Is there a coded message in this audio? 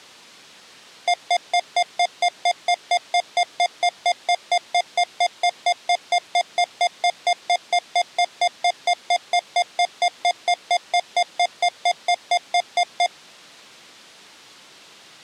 No, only evenly repeated beeps.